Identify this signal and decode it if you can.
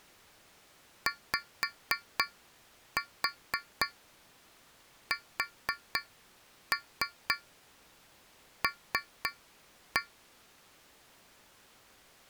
Tap code, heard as taps on a metal pipe, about 4 knocks a second. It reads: YSL